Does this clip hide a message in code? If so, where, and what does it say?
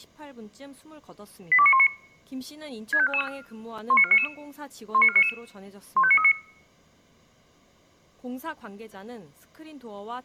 Yes: five-tone selective call (ZVEI) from 1.5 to 6.3 s, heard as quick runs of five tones, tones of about 70 ms, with speech in Korean. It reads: 82919 65444 19499 19499 15939